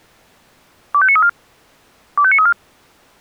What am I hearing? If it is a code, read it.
Five-tone selective call (ZVEI), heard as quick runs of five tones, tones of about 70 ms. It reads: 25934 25934